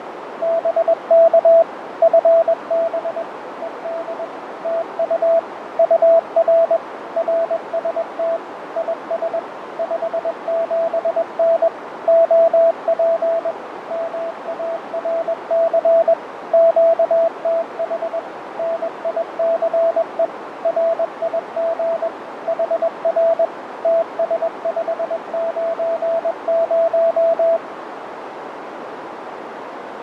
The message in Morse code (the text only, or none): BK FB ED TU UR RST IS 57N OP MARC QTH NICE RIG HR TS590